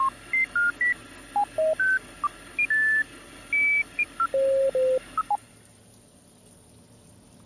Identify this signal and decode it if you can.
Electronic bleeps of random pitch and length, with kitchen noise. There is no code.